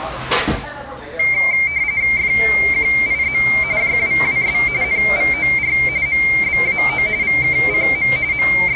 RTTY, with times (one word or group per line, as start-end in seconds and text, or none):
2.2-3.4 FQIZ
3.8-4.6 JWWS
4.8-5.8 NVOR
6.1-7.1 MBAO
7.2-8.1 VKCM
8.3-8.8 …